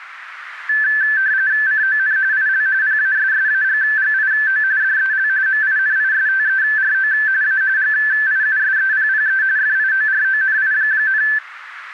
RTTY (45.45 baud, 170 Hz shift), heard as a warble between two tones, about 1650 Hz centre, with radio static. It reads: CON IL PASSAGGIO DEL MINISTERO A GIUSEPPE FIORONI,